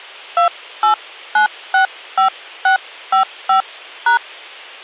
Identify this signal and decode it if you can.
DTMF, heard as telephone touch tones, dialled by hand, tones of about 110 ms. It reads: 28965655#